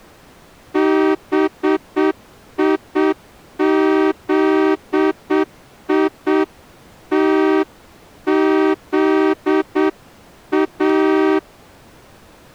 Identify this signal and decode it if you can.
Morse code, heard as a horn, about 7 wpm. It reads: BIZITZA